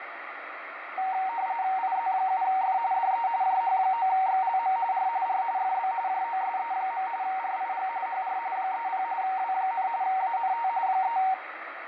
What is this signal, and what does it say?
RTTY (45.45 baud, 170 Hz shift), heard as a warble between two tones, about 840 Hz centre, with radio static. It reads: IZ7F DE JH9XLM R R FB JOSE. RIG HR 30 W, ANT 3